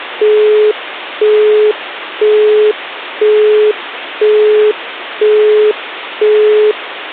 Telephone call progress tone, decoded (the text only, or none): busy tone